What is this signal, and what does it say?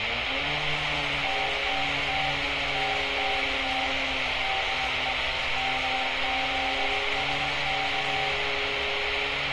Morse code, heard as a keyed tone, hand-sent with a paddle, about 19 wpm, 780 Hz, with heavy radio static and street noise. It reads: TTT TTT DE MZSK